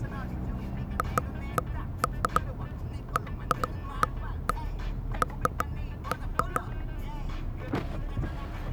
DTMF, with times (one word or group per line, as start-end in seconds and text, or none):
none